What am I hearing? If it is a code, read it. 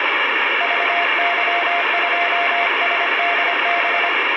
Morse code, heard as a keyed tone, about 25 wpm, 700 Hz, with radio static and room echo. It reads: VY2SDB